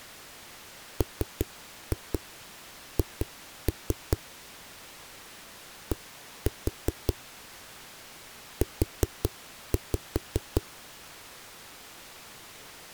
Tap code, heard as knocks on a wall, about 5 knocks a second. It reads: MH D U